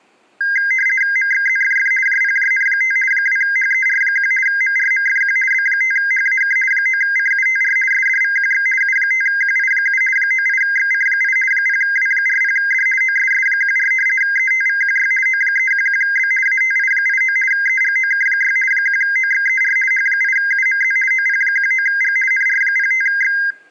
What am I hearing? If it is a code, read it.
RTTY (50 baud, 450 Hz shift), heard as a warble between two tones, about 1850 Hz centre. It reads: MXZFF JPJN5 2HER1 MRMFQ B5HAK 9CUTR SDVQX U5QI7 98XC8 0W40D OSS14 ETVQY O311B ATI89 EGOK6 1OXER H8UMZ OP19G NR05X